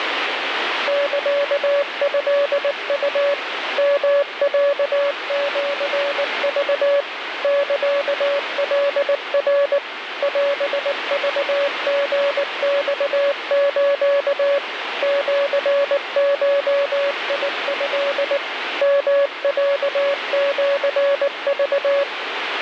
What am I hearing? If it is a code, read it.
Morse code (Japanese Wabun code), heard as a keyed tone, machine-sent, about 19 wpm, 570 Hz, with radio static. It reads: サトウ ヨロシク サカナ オクリマス シゴト ヨロシク